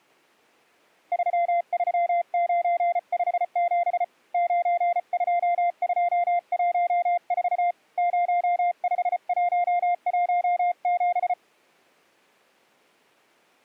Morse code, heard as a keyed tone, hand-sent with a paddle, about 34 wpm, 700 Hz. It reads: 33957 92214 05117